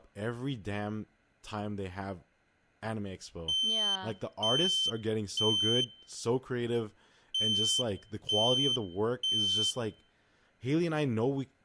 Alarm pattern, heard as an alarm's beeps, played twice, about 3100 Hz, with speech in English. Temporal three. Smoke or fire, evacuate.